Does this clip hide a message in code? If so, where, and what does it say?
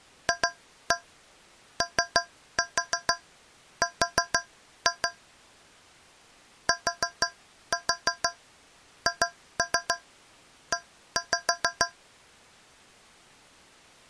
Yes: tap code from 0.3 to 12.0 s, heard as taps on a metal pipe, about 6 knocks a second. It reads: FOR THE